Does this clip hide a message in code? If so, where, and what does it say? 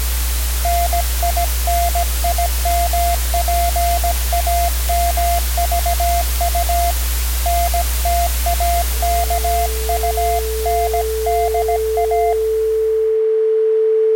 Yes: Morse code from 0.6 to 12.4 s, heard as a keyed tone, hand-sent with a paddle, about 17 wpm, 690 Hz. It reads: NINIMPAMVU NTAKUNDA